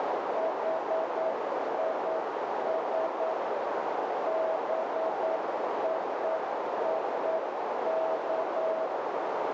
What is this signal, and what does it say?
Morse code (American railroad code), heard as a keyed tone, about 650 Hz, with heavy radio static and a narrow filter. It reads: HIS BOOK